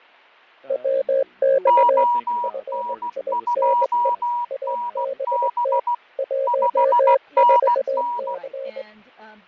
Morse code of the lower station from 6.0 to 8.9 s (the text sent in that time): 14C